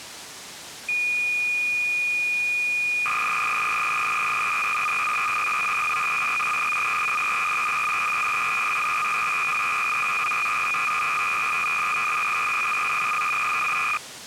Cassette data (Kansas City type), 300 baud, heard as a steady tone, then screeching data.